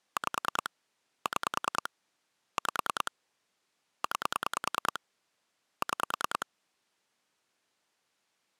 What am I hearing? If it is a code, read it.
Pulse dialling, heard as clicks on a phone line, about 10 pulses a second. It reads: 5 6 5 9 6